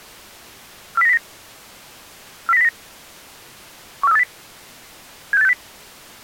Five-tone selective call (EEA), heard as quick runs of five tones, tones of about 40 ms. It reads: 40909 40909 14380 76860